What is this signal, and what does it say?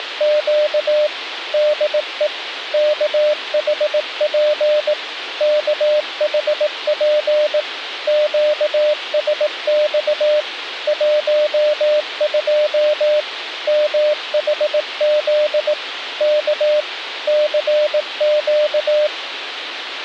Morse code, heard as a keyed tone, machine-sent, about 18 wpm, 600 Hz, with radio hiss. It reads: … DE KHP KHP QSX 12 MHZ K CQ